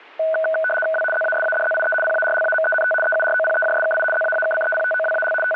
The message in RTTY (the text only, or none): W ZASADZIE PARLAMENT EUROPEJSKI ZAAKCEPTOWAL …